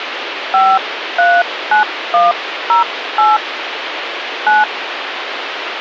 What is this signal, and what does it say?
DTMF, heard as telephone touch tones, dialled by hand, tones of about 180 ms, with phone line noise. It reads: 539108 9